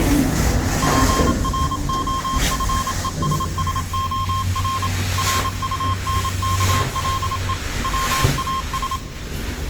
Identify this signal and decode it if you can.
Morse code, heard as a keyed tone, machine-sent, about 27 wpm, 1060 Hz, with the noise inside a lift. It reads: PROFESSOR RUNKLE WAS